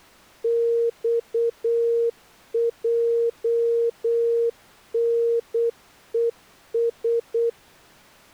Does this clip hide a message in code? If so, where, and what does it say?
Yes: Morse code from 0.4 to 7.6 s, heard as a keyed tone, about 8 wpm, 470 Hz. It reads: XJNES